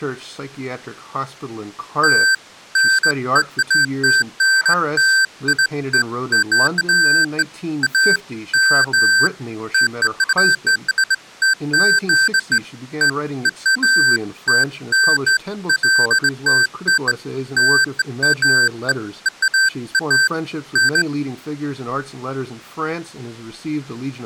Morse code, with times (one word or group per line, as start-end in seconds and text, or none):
none